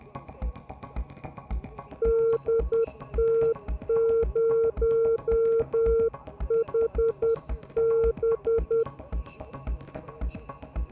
Morse code, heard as a keyed tone, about 10 wpm, 460 Hz. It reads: DT0HB